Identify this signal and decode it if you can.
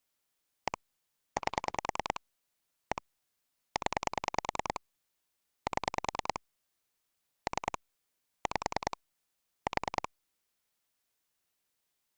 Pulse dialling, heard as clicks on a phone line, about 10 pulses a second. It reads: 1 8 1 0 7 3 5 4